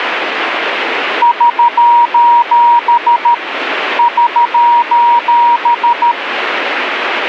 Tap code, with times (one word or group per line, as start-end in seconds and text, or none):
none